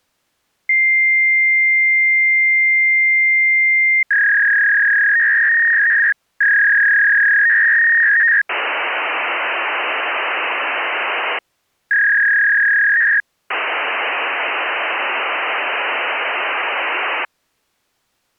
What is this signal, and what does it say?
Fax machine handshake, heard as a long tone, a warble and hiss.